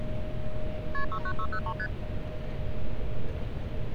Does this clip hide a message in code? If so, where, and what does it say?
Yes: multi-frequency trunk signalling (R1, as on North American trunks) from 0.9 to 1.9 s, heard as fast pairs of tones, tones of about 70 ms, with street noise. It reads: KP 69603 ST